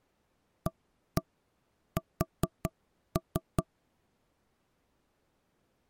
Tap code, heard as knocks on wood, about 5 knocks a second. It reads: AS